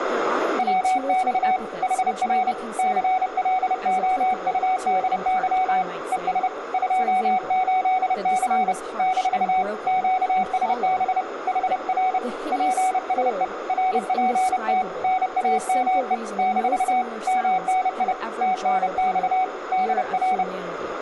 Morse code, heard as a keyed tone, hand-sent with a paddle, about 30 wpm, 750 Hz, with radio static, a narrow filter and speech in English. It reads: WX HR CLOUDY ES 28C - QSB HR PSE RPT NAME - MNI TNX DR